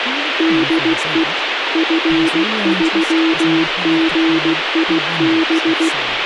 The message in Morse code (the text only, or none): DE F3GIB